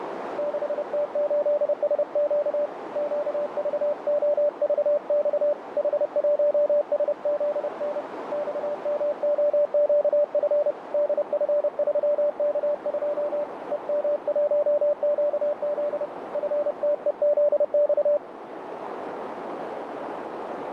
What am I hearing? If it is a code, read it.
Morse code, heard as a keyed tone, hand-sent with a paddle, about 30 wpm, 590 Hz, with radio static and a narrow filter. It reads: 6T8SQ QVOVX H1SZN XMOQF DF3K2 EM1QZ FTEZX